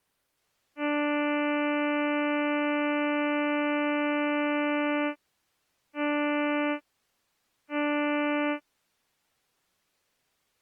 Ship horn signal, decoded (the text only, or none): 1 long, 2 short